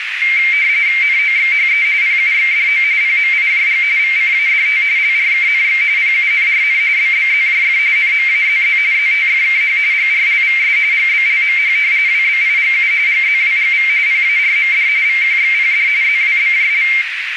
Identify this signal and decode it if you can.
RTTY (45.45 baud, 170 Hz shift), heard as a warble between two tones, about 2200 Hz centre, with radio static and a narrow filter. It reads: NOXHE PUXDO PMIJG VCADT LRKNX PUNRN BBZJF NMAZZ ZTFKH GRLVS GBLMH WBIGU GZWGV PARMD VQXPD ZWBJL